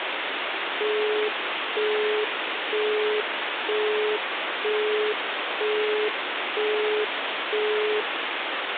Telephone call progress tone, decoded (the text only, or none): busy tone